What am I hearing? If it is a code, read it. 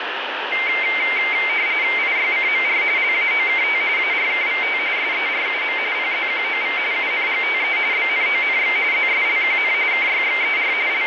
RTTY (45.45 baud, 170 Hz shift), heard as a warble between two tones, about 2200 Hz centre, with radio static and room echo. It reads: IYCMR LAOKT ARKVT SERUM PZQOV UNGTE BNONX ZSLQN KYXER …